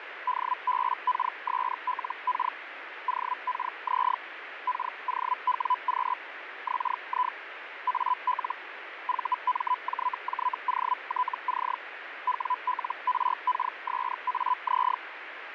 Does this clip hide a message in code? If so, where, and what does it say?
Yes: Hellschreiber (Feld-Hell, 122.5 baud) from 0.3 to 15.0 s, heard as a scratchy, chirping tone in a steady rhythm, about 1000 Hz, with radio static. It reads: DBKSLK OKZ KOWQ XI AL VMJJOTC WLRKSAZ